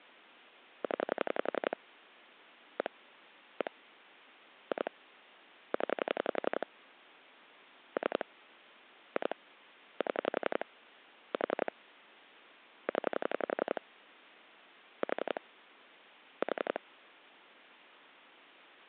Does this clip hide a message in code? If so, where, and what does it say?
Yes: pulse dialling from 0.8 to 16.8 s, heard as clicks on a phone line, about 11 pulses a second. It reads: 0 1 1 2 0 3 2 7 4 0 4 4